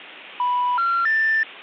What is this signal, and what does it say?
Telephone call progress tone (North American plan), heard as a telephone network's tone, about 980, 1370, 1800 Hz. Special information tone.